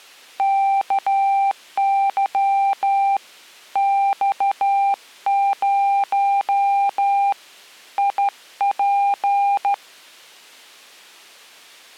Morse code, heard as a keyed tone, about 13 wpm, 790 Hz. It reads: KY X0 IP